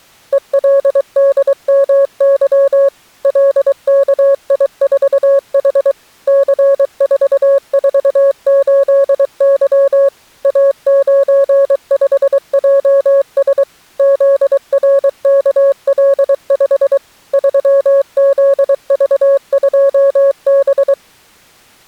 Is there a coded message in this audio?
Yes: Morse code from 0.3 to 21.0 s, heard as a keyed tone, machine-sent, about 23 wpm, 550 Hz. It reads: ELDMY LKI4H C448Y A95JS ZRKL5 3ZV2B